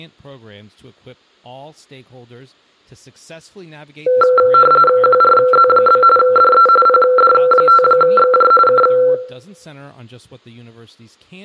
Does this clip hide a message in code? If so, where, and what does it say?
Yes: RTTY (45.45 baud, 850 Hz shift) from 4.1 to 9.1 s, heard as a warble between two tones, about 930 Hz centre, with room echo and speech in English. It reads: QRZ? DE PD5XJ K